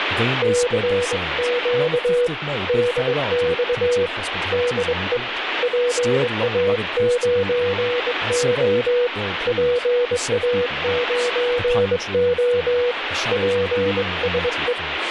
Morse code, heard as a keyed tone, hand-sent with a straight key, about 22 wpm, 490 Hz, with radio static and speech in English. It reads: CQ DX DE PA9O PA9O PSE